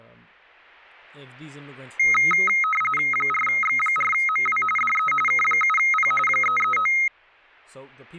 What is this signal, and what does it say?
RTTY (45.45 baud, 850 Hz shift), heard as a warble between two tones, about 1700 Hz centre, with speech in English. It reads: 4X4MW DE K7P 339